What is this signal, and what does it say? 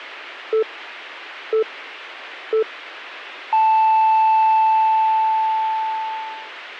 Radio time signal (three low pips and a long one an octave up, as on NHK), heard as pips.